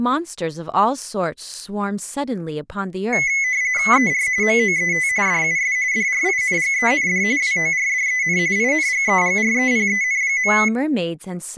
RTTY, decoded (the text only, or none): ER MOET DUS DRINGEND WORDEN INGEGREPEN.